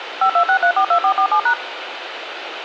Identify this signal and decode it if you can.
DTMF, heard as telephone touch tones, dialled by machine, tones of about 80 ms, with radio hiss. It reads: 526342447#